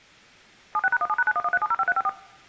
DTMF, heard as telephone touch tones, dialled by machine, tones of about 40 ms. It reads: 76#17#9113705354